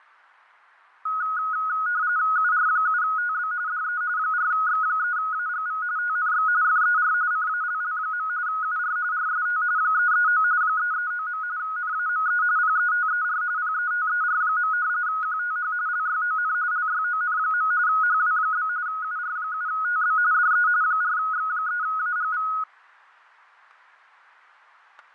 RTTY (45.45 baud, 170 Hz shift), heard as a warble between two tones, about 1360 Hz centre, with fading and static crashes. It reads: UR7TB DE 4X3AGV TNX FER CALL. UR RST 339 339. NAME PETER PETER. QTH LYON LYON. HW? UR7TB DE 4X3AGV